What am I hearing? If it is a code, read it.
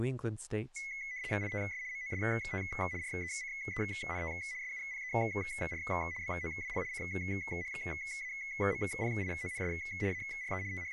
RTTY (75 baud, 170 Hz shift), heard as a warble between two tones, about 2100 Hz centre, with speech in English. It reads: ITS MOST RECENT SUPER BOWL CHAMPIONS ARE …